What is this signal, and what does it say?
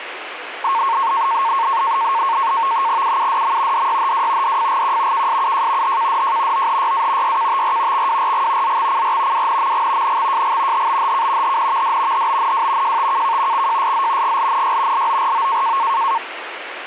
NAVTEX (SITOR-B), 100 baud, 170 Hz shift, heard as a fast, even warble, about 1000 Hz centre, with radio static. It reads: UUDM DYHW DFGQ KSUJ HKDJ OHYA YKTR XWRG ZXCR WNMG NXJG HBHK HNVD HBNW JTKK XJSZ GLNY LORO